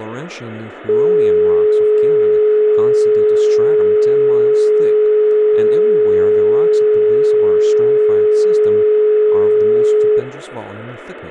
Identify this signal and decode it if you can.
Telephone call progress tone (425 Hz plan, as in most of Europe), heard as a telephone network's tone, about 420 Hz, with phone line noise, room echo and speech in English. Dial tone.